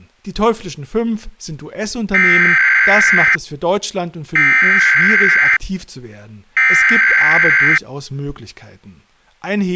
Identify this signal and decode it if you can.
Emergency Alert System (SAME) tones (header bursts), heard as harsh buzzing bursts, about 520.83 baud, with speech in German.